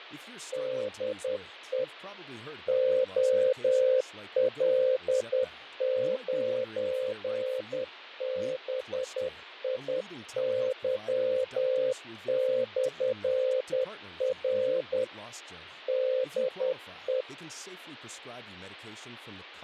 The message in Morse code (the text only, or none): DE OL9BIY/R DE